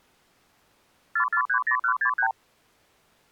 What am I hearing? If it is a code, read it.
Multi-frequency trunk signalling (R2, with the far end's replies), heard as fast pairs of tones, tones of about 90 ms. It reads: 4430163